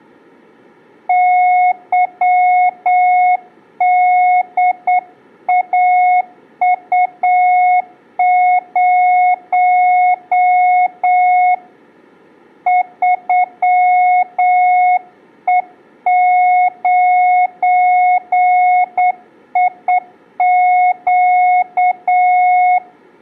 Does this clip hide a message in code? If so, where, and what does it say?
Yes: Morse code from 1.0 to 22.8 s, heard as a keyed tone, hand-sent with a straight key, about 8 wpm, 730 Hz, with room echo. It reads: YDAU0 3E9IQ